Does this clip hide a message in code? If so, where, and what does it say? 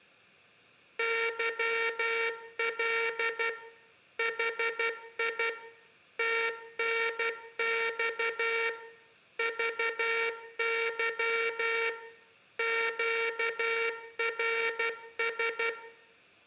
Yes: Morse code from 0.9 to 15.8 s, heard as a buzzer, machine-sent, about 12 wpm, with room echo. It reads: YL HI TNX VY QRS